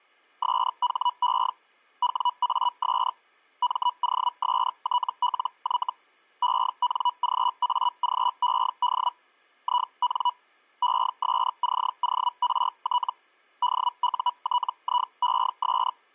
Hellschreiber (Feld-Hell, 122.5 baud), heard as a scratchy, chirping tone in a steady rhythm, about 980 Hz. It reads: SHE WAS MOSTLY ENGAGED IN ESCORT DUTIES